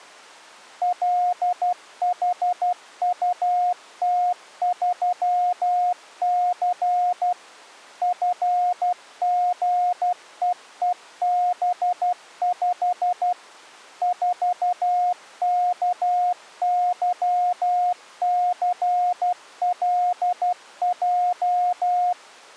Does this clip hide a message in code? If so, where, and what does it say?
Yes: Morse code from 0.8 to 22.2 s, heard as a keyed tone, machine-sent, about 12 wpm, 720 Hz. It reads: LHUT3C FGEEB5 4KYCLJ